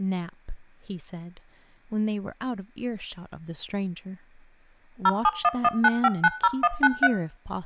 DTMF, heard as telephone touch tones, dialled by machine, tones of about 50 ms, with room echo and speech in English. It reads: 07119590193